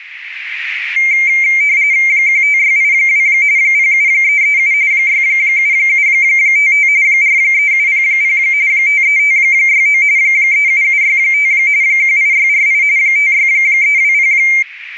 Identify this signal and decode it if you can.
RTTY (45.45 baud, 170 Hz shift), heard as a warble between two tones, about 2200 Hz centre, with radio static and a narrow filter. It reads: 15682 07337 67755 43700 53569 37765 18648 56320